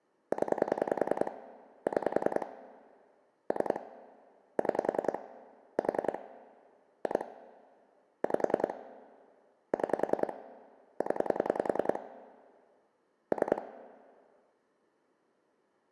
Pulse dialling, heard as clicks on a phone line, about 10 pulses a second, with room echo. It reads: 0 6 3 6 4 2 5 6 0 3